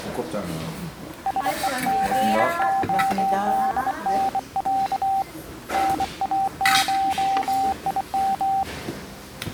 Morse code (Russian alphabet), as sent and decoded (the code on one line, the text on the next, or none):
... . --. --- -.. -. .-.- / -. .- ---- .. --
СЕГОДНЯ НАШИМ